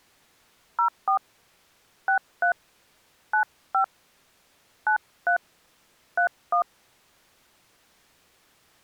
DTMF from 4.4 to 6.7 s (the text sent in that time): 93 31